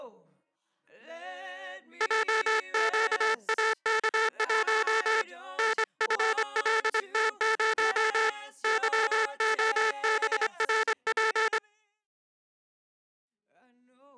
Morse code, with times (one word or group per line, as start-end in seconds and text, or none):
2.0-5.2 JQAK1
5.6-8.3 NFLT0
8.6-11.6 YOBRP